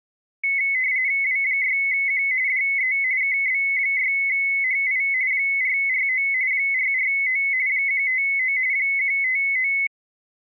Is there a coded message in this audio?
Yes: RTTY (45.45 baud, 170 Hz shift) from 0.4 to 9.9 s, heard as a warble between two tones, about 2100 Hz centre. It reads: W6Q DE KB6HI 449 449 159 159